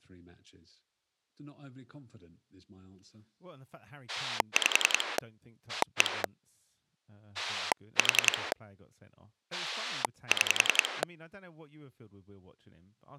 Pulse dialling, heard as a rotary dial, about 10 pulses a second, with speech in English. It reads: 5 1 4 6